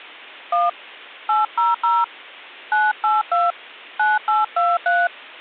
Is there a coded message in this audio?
Yes: DTMF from 0.5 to 5.1 s, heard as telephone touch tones, dialled by hand, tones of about 190 ms. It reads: 1 800 982 9823